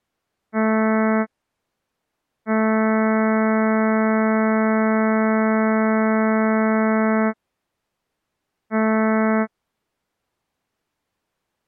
Ship horn signal, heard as a ship's horn, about 220 Hz. 1 short, 1 long, 1 short. At sea: a vessel at anchor warns of its position.